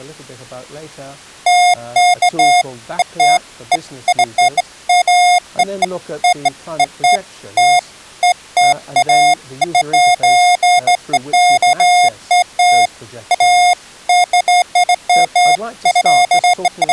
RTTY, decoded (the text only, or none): none